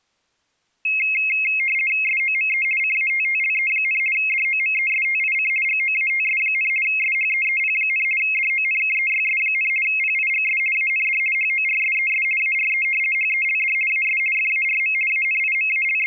RTTY (50 baud, 450 Hz shift), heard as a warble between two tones, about 2350 Hz centre. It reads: SOME CATTLE, DOMESTIC GOATS, SHEEP, DONKEYS, PIGS AND HORSES ARE HELD AS FARM …